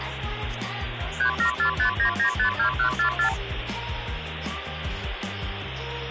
Multi-frequency trunk signalling (R2, with the far end's replies), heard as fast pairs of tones, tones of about 100 ms, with phone line noise. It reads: 37459952144